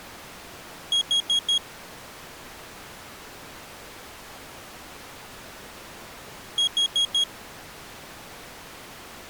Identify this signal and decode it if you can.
Alarm pattern, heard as an alarm's beeps, played twice, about 3300 Hz. Temporal four. Carbon monoxide.